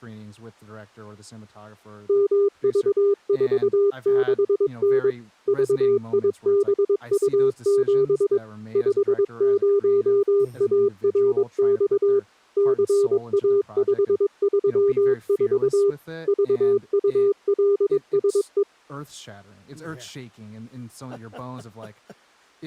Morse code, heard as a keyed tone, machine-sent, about 22 wpm, 400 Hz, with speech in English. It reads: MV46N VIBU7 50ARX CA534 VULSE